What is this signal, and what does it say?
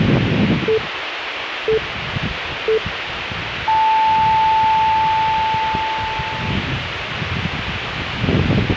Radio time signal (three low pips and a long one an octave up, as on NHK), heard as pips, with radio hiss and the noise of a residential street.